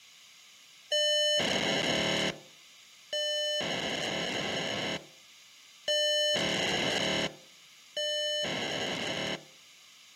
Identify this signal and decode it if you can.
POCSAG pager data (1200 baud), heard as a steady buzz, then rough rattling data.